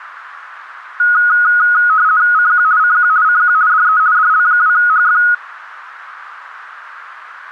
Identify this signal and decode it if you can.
RTTY (50 baud, 170 Hz shift), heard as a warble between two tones, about 1360 Hz centre, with radio static. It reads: CQ CQ CQ DE DL2HF